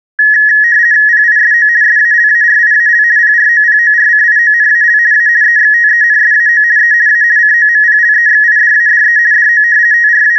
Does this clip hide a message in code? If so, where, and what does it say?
Yes: RTTY (50 baud, 170 Hz shift) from 0.2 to 10.4 s, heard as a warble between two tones, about 1800 Hz centre. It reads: PISO SALARIAL PROPORCIONAL A EXTENSAO E A COMPLEXIDADE DO …